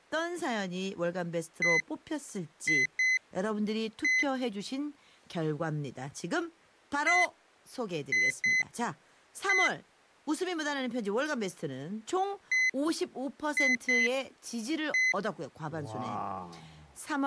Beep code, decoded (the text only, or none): 1-2-1